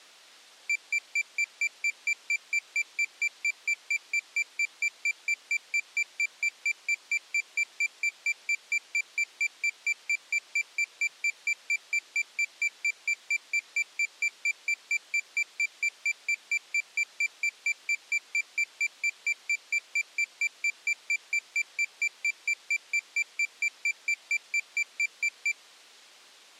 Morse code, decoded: none

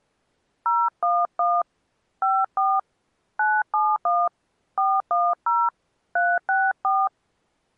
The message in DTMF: 011 54 971 410 364

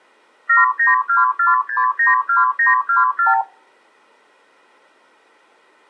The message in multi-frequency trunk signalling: 7924692924

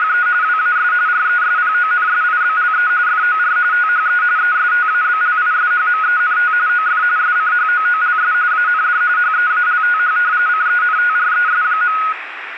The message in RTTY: … WAS RESPONSIBLE FOR THE ESTABLISHMENT OF SCHOOLS AND HEALTH CENTRES.

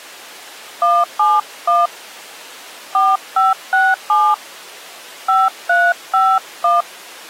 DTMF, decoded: 171 4567 5351

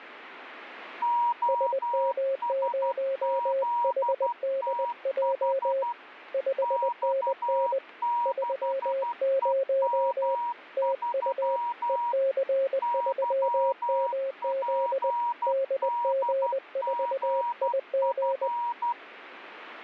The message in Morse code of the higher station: OSZTH X6EM3 YPDGF

